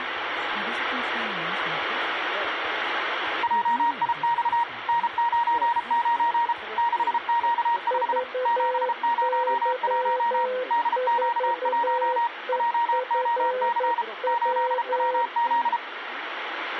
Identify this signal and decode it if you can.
Morse code, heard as two keyed tones, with radio static. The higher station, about 33 wpm, 940 Hz: JIX N99 6Q5 701 DQ1 JOC 8WZ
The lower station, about 11 wpm, 510 Hz: VY4EFW